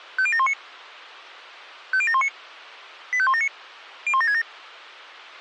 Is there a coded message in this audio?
Yes: five-tone selective call (ZVEI) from 0.2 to 4.4 s, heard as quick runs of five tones, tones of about 70 ms. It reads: 50719 50719 85179 01767